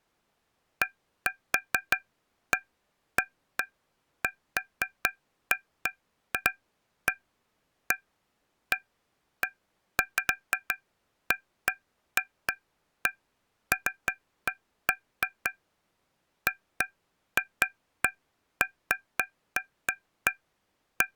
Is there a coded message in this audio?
No, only irregular taps on a metal pipe.